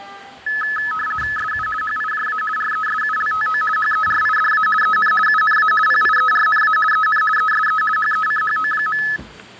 RTTY (50 baud, 450 Hz shift), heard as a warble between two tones, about 1500 Hz centre, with fading, static crashes and the noise of a cafe. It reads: SU HIJA RESULTO HERIDA EN UNA PIERNA EN ESE HECHO.